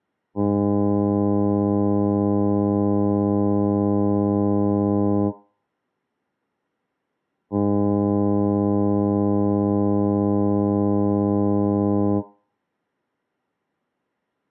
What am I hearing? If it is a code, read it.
Ship horn signal, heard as a ship's horn, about 100 Hz, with room echo. 2 long. At sea: a vessel under power that has stopped in fog.